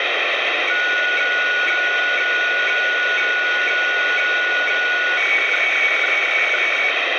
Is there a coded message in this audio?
Yes: weather fax (radiofax), 120 lines a minute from 0.7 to 6.9 s, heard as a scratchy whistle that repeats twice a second, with heavy radio static.